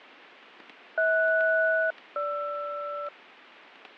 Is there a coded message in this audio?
Yes: aircraft SELCAL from 1.0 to 3.1 s, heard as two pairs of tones, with radio static, fading and static crashes. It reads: HS-GR